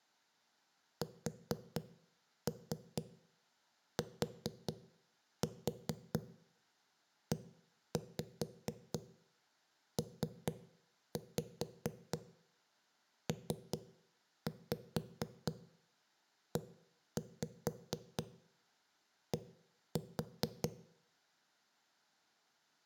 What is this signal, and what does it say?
Tap code, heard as knocks on a wall, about 4 knocks a second, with room echo. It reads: STEPPED